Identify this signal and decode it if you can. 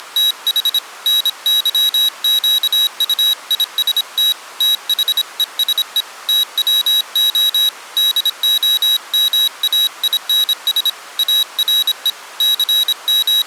Morse code, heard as a high beeper, hand-sent with a paddle, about 26 wpm, 3850 Hz. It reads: … NYQUIST THESE TWO DOMAINS ARE …